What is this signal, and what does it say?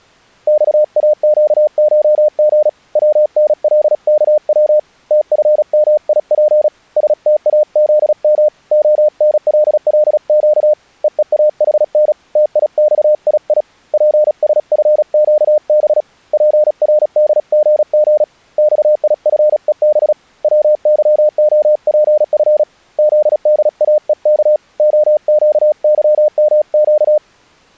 Morse code (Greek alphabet), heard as a keyed tone, hand-sent with a paddle, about 36 wpm, 600 Hz. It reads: ΞΑΨΧΓ ΩΝΛΚΩ ΤΦΜΙΠ ΣΤΑΖΜ ΟΝΛΛΨ ΕΕΑΗΝ ΤΙΞΙΙ ΠΣΦΨΒ ΠΡΔΓΓ ΞΙΦΕΒ ΩΥΟΠΦ ΖΔΑΕΚ ΟΨΥΜΨ